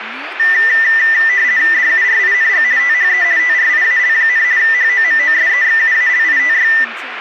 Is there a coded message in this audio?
Yes: RTTY (50 baud, 170 Hz shift) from 0.4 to 6.8 s, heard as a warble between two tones, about 1900 Hz centre, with radio static and speech in Nepali. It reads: DURING THE TRIAL, HOMOSEXUALITY